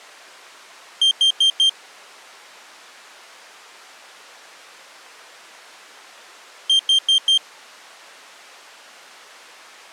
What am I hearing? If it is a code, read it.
Alarm pattern, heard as an alarm's beeps, played twice, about 3150 Hz. Temporal four. Carbon monoxide.